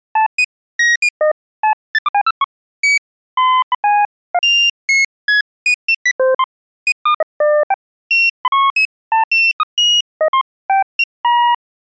Electronic bleeps of random pitch and length. There is no code.